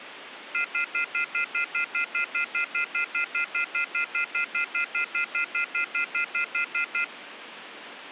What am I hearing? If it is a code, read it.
Telephone call progress tone (North American plan), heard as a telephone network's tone, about 1400, 2050, 2450, 2600 Hz, 0.1 s on and 0.1 s off, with phone line noise. Off-hook warning tone.